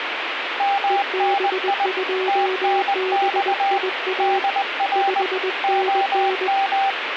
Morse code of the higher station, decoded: MNI TNX DR OM

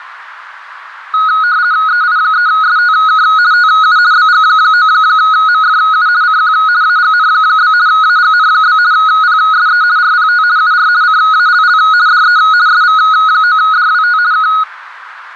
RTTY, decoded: EI3STK TU BG9MFU CQ AGN? AGN? PSE RPT UR CALL DE SV9DWT K

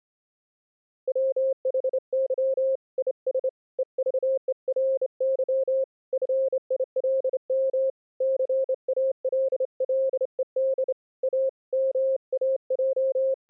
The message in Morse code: WHY IS EVERY FILM CALLED A …

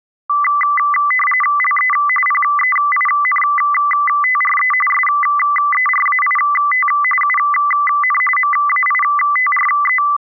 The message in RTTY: LE PEINTRE SERAIT UN MAITRE

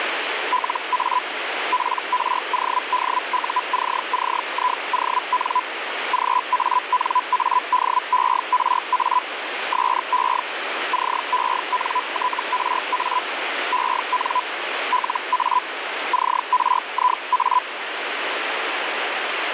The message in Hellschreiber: LA PRODUCCION GANADERA SE CENTRA EN LA CRIA

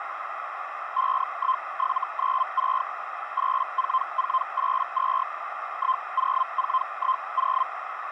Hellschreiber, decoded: 51796 84482 10410

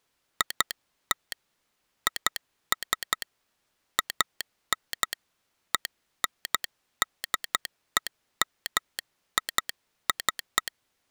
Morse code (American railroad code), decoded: IT IS AN ENDEMIC

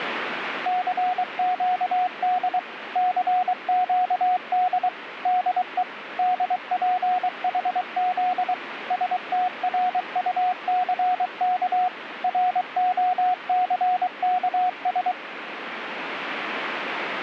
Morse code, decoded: CQD CQD DE DPHZ STRUCK ROCKS

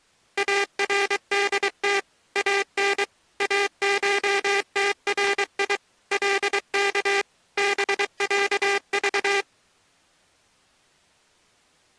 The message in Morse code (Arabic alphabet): اردت ان اشتري لك بعض

